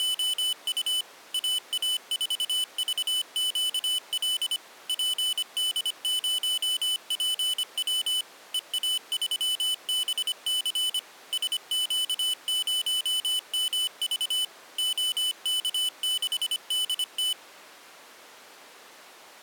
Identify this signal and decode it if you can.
Morse code, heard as a high beeper, machine-sent, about 25 wpm, 3000 Hz. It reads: … AA4VQL PD0PW EA3BC SQ0MV OK6DT